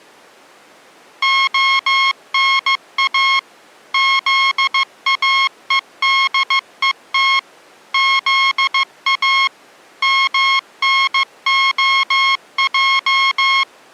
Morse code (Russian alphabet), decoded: ОНА ЗАЕДЕТ ЗА МНОЙ

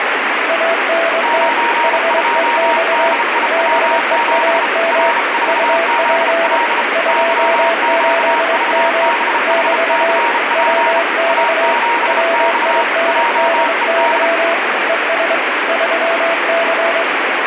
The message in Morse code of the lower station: ANT HEX BEAM UP 28M <BT> WX WINDY ES 3C

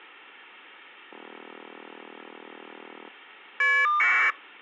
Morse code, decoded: none

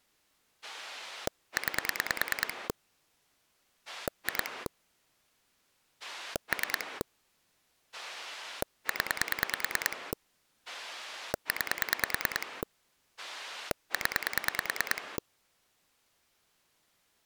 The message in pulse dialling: 9 2 3 0 9 0

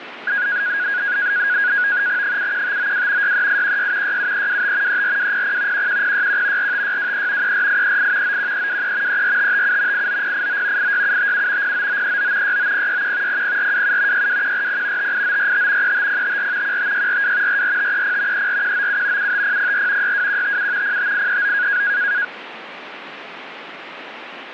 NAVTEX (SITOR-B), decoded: 71592 63816 67325 34200 11061 45623 34838 91323 34557 89089 86757 09939 69061 00427 62140 58945 35054 15642 44530 34197 75004 62157 05839

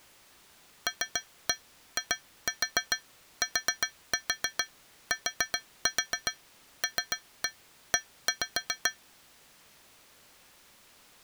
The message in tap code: LITTLE

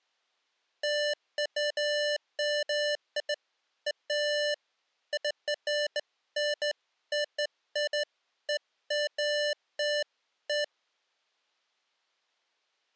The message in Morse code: none

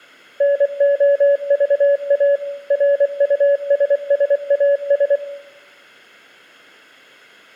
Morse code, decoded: NOVA RUSSAS

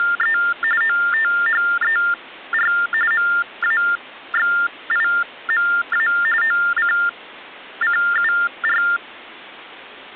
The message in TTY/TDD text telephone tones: … OTHER MAXIMA OCCUR

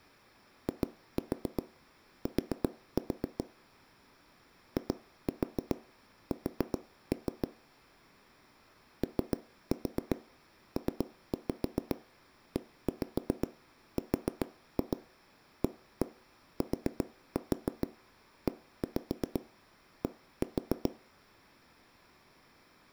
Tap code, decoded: IT IS OPERATED

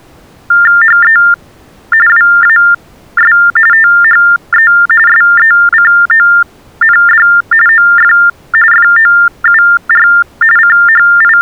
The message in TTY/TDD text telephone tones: HE WAS THE SECOND OF FOUR …

